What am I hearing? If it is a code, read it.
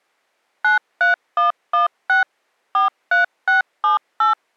DTMF, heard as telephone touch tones, dialled by machine, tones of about 130 ms. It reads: 93116 43678